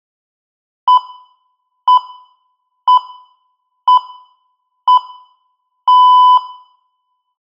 Radio time signal (six pips, as the Greenwich Time Signal), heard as pips, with room echo.